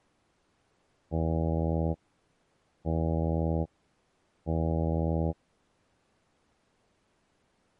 Ship horn signal, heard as a ship's horn, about 80 Hz. 3 short. At sea: I am operating astern propulsion.